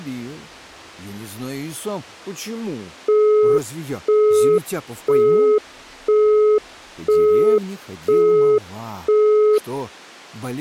Telephone call progress tone (single-tone plan, as in Europe, Japan and elsewhere), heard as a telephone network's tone, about 420 Hz, 0.5 s on and 0.5 s off. Busy tone.